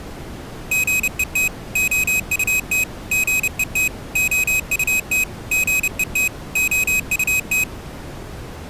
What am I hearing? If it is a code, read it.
Morse code, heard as a high beeper, machine-sent, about 30 wpm, 2550 Hz. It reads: GET OUT GET OUT GET OUT